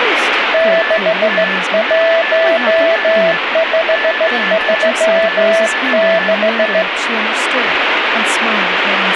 Morse code, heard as a keyed tone, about 15 wpm, 660 Hz, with radio static, a weaker station near 1740 Hz and speech in English. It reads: 61536